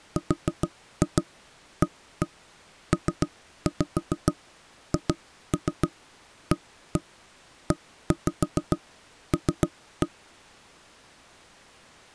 Tap code, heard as knocks on wood, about 7 knocks a second. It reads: RAPHAEL